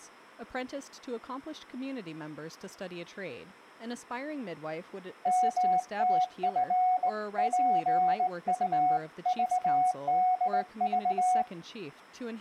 Morse code (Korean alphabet), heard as a keyed tone, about 19 wpm, 740 Hz, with speech in English. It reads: 먼지를